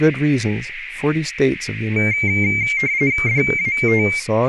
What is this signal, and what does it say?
RTTY (45.45 baud, 170 Hz shift), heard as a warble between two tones, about 2200 Hz centre, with radio static, a narrow filter and speech in English. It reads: DAT